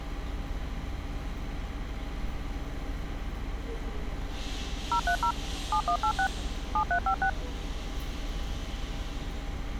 DTMF, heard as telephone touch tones, dialled by machine, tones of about 80 ms, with street noise. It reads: 030 7186 7356